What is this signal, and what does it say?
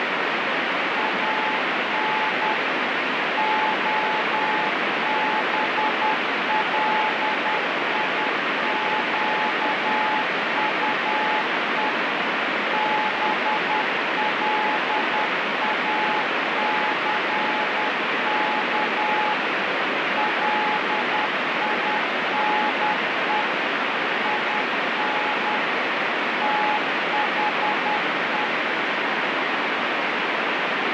Morse code, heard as a keyed tone, machine-sent, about 10 wpm, 860 Hz, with heavy radio static. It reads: AN OBLIQUE BLACK LINE IN THE